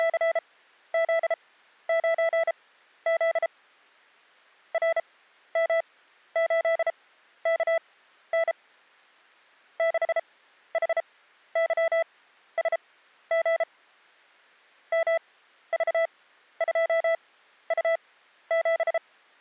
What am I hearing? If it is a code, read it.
Morse code, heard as a keyed tone, machine-sent, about 33 wpm, spaced as for 13 wpm, 660 Hz. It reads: … RM8KN 6HYSG MV2U7